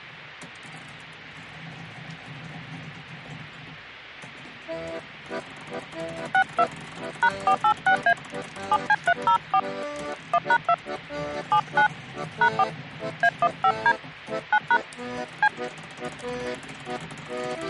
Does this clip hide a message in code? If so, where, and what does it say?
Yes: DTMF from 6.3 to 15.5 s, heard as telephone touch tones, dialled by hand, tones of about 70 ms. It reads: 62 #486A 7C304 1#2 79 #4 A15D 9# C